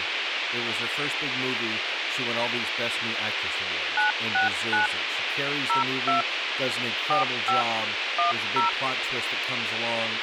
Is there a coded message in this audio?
Yes: DTMF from 4.0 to 8.7 s, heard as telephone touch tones, dialled by machine, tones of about 130 ms, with radio hiss and speech in English. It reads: 969 02 45 10